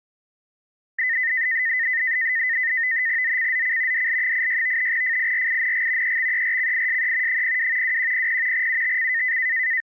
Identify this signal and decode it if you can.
NAVTEX (SITOR-B), 100 baud, 170 Hz shift, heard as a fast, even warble, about 1900 Hz centre. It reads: ZCZC DL86 FIRING EXERCISE 02 2100 UTC